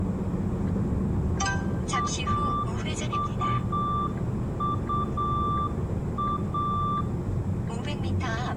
Morse code (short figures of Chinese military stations), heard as a keyed tone, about 8 wpm, 1180 Hz, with room echo and the noise inside a car. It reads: 1221